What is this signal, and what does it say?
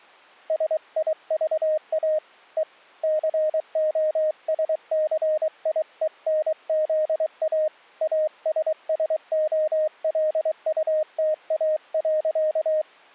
Morse code, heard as a keyed tone, hand-sent with a paddle, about 23 wpm, 620 Hz. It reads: SIVA E COSCIENZA ASSOLUTA.